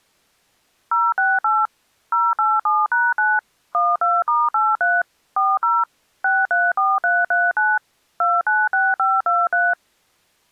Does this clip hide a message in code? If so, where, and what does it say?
Yes: DTMF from 0.9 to 9.7 s, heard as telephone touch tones, dialled by machine, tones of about 210 ms. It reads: 068 087#9 12*83 40 634339 296523